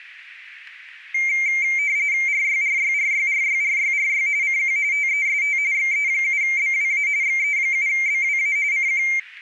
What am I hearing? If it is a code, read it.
RTTY (45.45 baud, 170 Hz shift), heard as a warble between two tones, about 2200 Hz centre. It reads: RYRYRYRYRYRY CQ TEST XE7BWA XE7BWA CQ